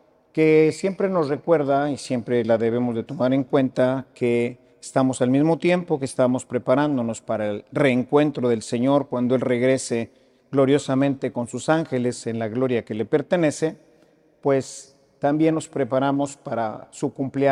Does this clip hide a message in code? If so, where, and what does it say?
No.